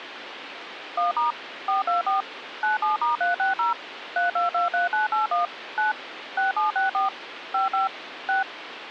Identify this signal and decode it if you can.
DTMF, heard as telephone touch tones, dialled by machine, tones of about 140 ms, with phone line noise. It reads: 1* 424 97*360 3223981 9 6764 55 6